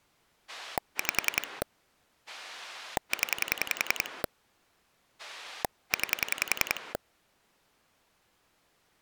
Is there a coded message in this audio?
Yes: pulse dialling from 0.5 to 7.0 s, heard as a rotary dial, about 10 pulses a second. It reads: 5 0 9